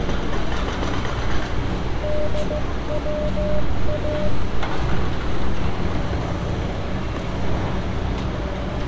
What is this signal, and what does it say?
Morse code (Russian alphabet), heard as a keyed tone, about 15 wpm, 600 Hz, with street noise. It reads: ДВА